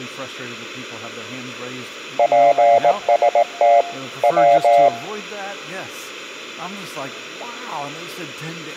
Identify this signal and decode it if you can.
Morse code (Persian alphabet), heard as a keyed tone, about 18 wpm, 690 Hz, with room echo. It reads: پست و